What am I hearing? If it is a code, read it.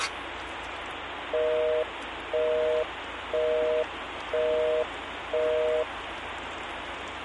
Telephone call progress tone (North American plan), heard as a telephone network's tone, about 480, 620 Hz, 0.5 s on and 0.5 s off, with phone line noise and kitchen noise. Busy tone.